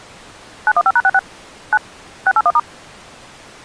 DTMF, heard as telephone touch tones, dialled by machine, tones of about 50 ms. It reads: 915#66 9 681*